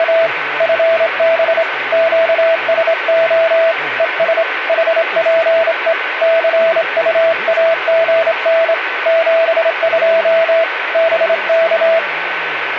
Morse code, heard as a keyed tone, hand-sent with a straight key, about 26 wpm, 660 Hz, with radio static and a steady whistle near 1520 Hz. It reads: … FB QSO ES HPE CUAGN 72 BK